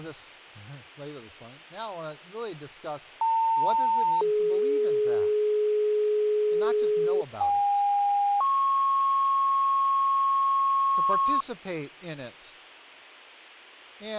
Two-tone page, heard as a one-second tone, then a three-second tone, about 900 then 420 Hz, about 810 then 1090 Hz, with speech in English.